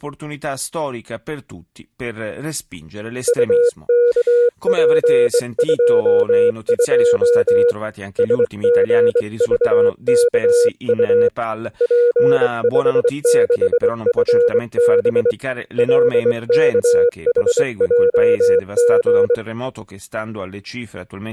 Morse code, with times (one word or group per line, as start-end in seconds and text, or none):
3.3-7.7 UKP22
8.2-11.3 SGVKU
11.8-15.3 P56FB
15.8-19.3 LKHJG